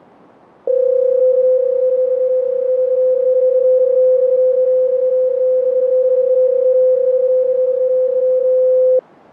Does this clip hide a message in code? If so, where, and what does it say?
Yes: PSK31 (31.25 baud) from 0.7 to 9.0 s, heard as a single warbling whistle, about 510 Hz.